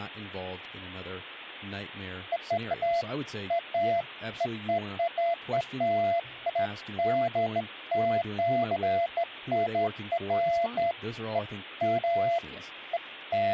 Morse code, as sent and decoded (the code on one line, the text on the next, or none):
none